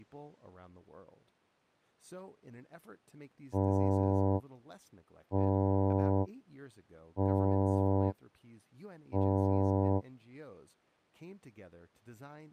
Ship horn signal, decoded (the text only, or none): 4 short